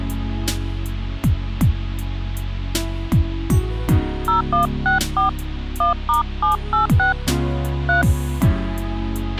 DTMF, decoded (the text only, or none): 0164 1*786 3